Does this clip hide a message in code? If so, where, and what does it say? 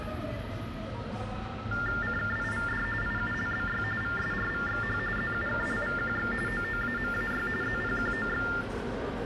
Yes: TTY/TDD text telephone tones (45.45 baud Baudot) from 1.7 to 8.6 s, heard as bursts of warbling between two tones, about 400 Hz shift, 1600 Hz centre, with phone line noise, room echo and the noise of a subway station. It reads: CKIVD IULBY VSRVXH ZUKLVQX OOAMAY ZPQOX